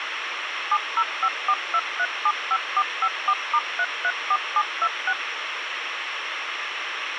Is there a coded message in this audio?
Yes: DTMF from 0.7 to 5.1 s, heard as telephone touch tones, dialled by machine, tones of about 60 ms, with radio hiss. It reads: 70542375454*334726